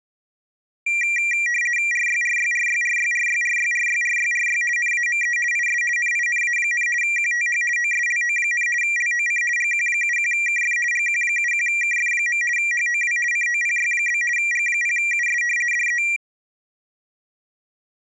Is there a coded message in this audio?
Yes: RTTY (50 baud, 450 Hz shift) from 0.9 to 16.2 s, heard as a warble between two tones, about 2150 Hz centre. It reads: RYRYRYRYRYRYRYRYRY NAME IS NINA, QTH OSLO, LOC GQ71KF GQ71KF. HOW COPY? G0US DE